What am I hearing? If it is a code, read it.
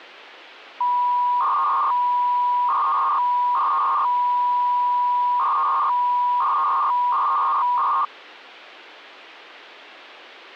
300-baud modem data (V.21 tones), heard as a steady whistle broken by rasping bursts, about 300 baud, 200 Hz shift.